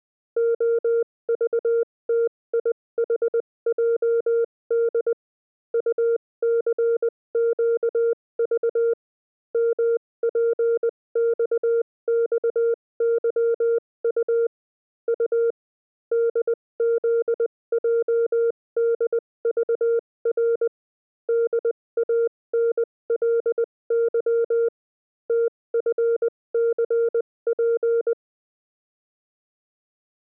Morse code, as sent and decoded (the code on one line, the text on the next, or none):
--- ...- - .. .... .--- -.. / ..- -.-. --.- ...- / -- .--. -..- -..- -.-- ..- / ..- / -.. --.. .--- -.. ...- .-. / -.. .- -. .-.. -.-- / - ..-. -.-. .--.
OVTIHJD UCQV MPXXYU U DZJDVR DANLY TFCP